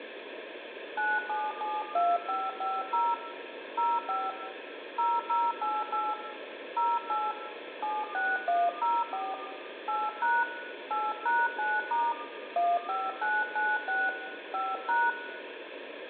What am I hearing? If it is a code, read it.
DTMF, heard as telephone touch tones, dialled by hand, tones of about 220 ms, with phone line noise and room echo. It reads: 9772550 05 0088 08 76104 8# 8#9* 15996 5#